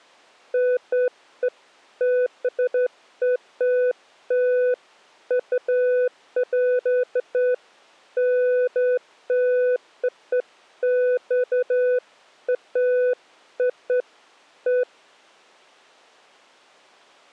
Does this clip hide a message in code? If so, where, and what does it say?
No, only beeps of irregular length.